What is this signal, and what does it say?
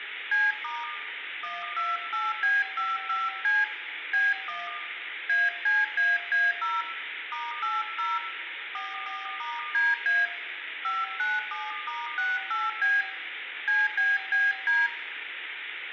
DTMF, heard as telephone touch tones, dialled by hand, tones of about 200 ms, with phone line noise and room echo. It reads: C* 128B55C B1 ACAA0 *80 44*DA 597*68B CBBD